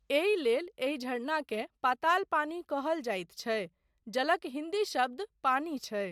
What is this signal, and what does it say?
Speech in Maithili. There is no code.